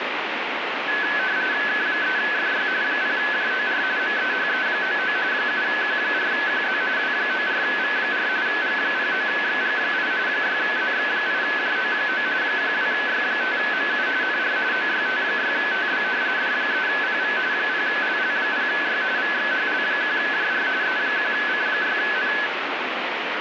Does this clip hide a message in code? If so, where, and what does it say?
Yes: RTTY (45.45 baud, 170 Hz shift) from 0.9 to 22.5 s, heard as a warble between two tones, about 1600 Hz centre, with radio static. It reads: K3FY 0JOR MEHE99 7Q4QZ W94V4 G09XG8 6ZX8JO9 12Y5MU NR OYT6TB D3PV 0LL0Y VXHL1JR E1C6N